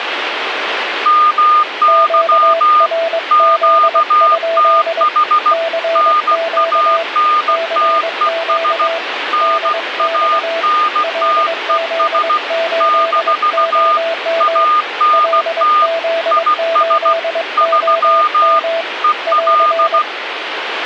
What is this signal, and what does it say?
Morse code, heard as two keyed tones, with radio static. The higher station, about 16 wpm, 1220 Hz: MY QTH NANTES NANTES - ANT IS 3 EL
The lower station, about 22 wpm, 660 Hz: QRZ? CQ CQ DX LZ8OM LZ8OM <AR>